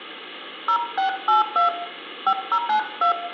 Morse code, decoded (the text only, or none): none